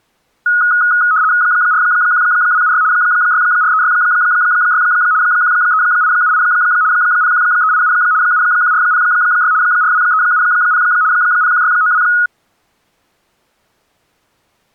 RTTY (75 baud, 170 Hz shift), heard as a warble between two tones, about 1360 Hz centre. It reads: 41276 64366 13878 01387 71406 42370 01692